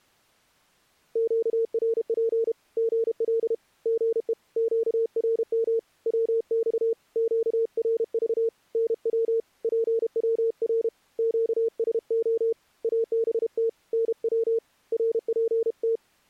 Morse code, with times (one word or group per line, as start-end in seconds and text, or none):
1.2-2.5 QRP
2.8-3.5 GL
3.9-4.3 GE
4.6-5.8 QRM
6.1-6.9 WX
7.2-8.5 QRV
8.8-9.4 NW
9.6-10.9 PWR
11.2-12.5 QSO
12.8-13.7 ABT
13.9-14.6 NW
14.9-16.0 RPT